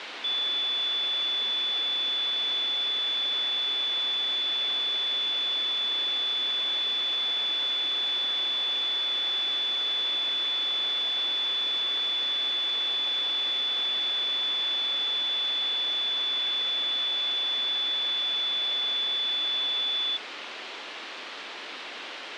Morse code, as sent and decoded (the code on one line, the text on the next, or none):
none